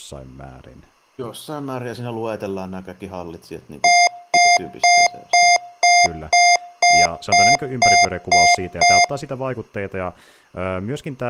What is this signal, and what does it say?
Beep code, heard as beeps from a small speaker, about 700 Hz, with speech in Finnish. 11 short. In AMI BIOS tables: cache memory error.